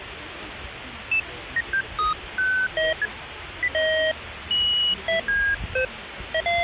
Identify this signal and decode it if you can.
Electronic bleeps of random pitch and length, with phone line noise and the noise of a restaurant. There is no code.